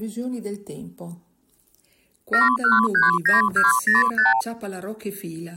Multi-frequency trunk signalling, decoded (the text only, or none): 7139205